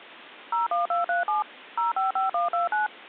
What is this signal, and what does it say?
DTMF, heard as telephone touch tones, dialled by machine, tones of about 140 ms. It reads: 01237 055129